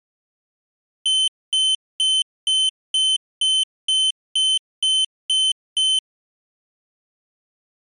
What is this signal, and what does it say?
Beep code, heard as a piezo beeper, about 3050 Hz. 11 short. In AMI BIOS tables: cache memory error.